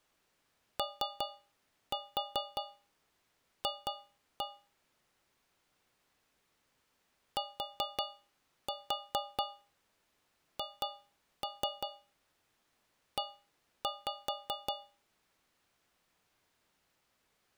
Tap code, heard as taps on a metal pipe, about 5 knocks a second. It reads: OF THE